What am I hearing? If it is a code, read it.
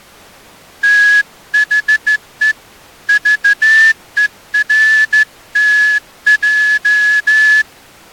Morse code, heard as a whistle, hand-sent with a straight key, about 14 wpm. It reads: THE VERTJ